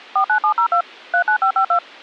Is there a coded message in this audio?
Yes: DTMF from 0.2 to 1.8 s, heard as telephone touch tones, dialled by machine, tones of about 90 ms. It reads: 49702 39552